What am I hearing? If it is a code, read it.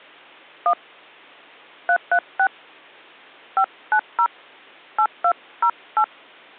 DTMF, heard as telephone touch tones, dialled by hand, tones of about 70 ms. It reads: 1 336 590 8208